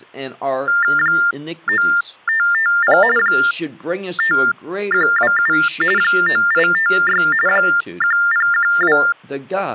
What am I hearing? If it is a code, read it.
TTY/TDD text telephone tones (45.45 baud Baudot), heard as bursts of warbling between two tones, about 400 Hz shift, 1600 Hz centre, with speech in English. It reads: 9550 5127 9856 1012